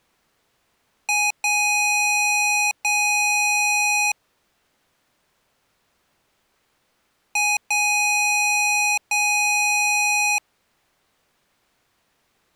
Beep code, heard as beeps from a small speaker, played twice, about 830 Hz. 1 short, 2 long.